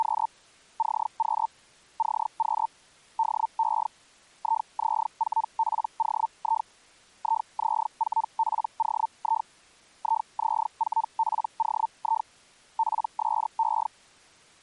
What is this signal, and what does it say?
Hellschreiber (Feld-Hell, 122.5 baud), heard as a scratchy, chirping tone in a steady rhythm, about 900 Hz. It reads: … CQ CQ DE IZ4POI IZ4POI IZ4POI PSE